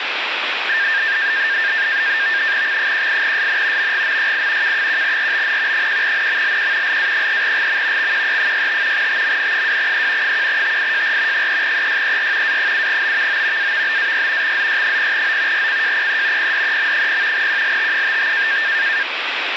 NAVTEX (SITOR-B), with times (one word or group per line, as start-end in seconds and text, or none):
2.6-3.9 X18SN
3.8-4.7 MGMYI
4.6-5.9 K1RBN
5.7-7.0 1NMLQ
6.8-8.1 LA3GM
8.0-9.1 XQE65
8.9-10.3 TMN2E
10.2-11.5 1TIJR
11.3-12.6 3EYER
12.4-13.7 A7BVO
13.6-14.5 AVBAY
14.4-15.7 XZY0O
15.5-16.5 RCJPE
16.4-17.5 PDEM0
17.3-18.6 QLT55